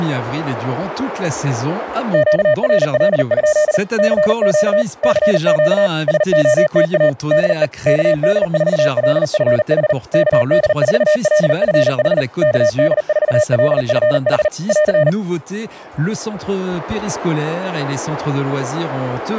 Morse code, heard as a keyed tone, machine-sent, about 39 wpm, 610 Hz. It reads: QRL? CQ CQ SOTA DE KD4LFH KD4LFH KD4LFH <AR>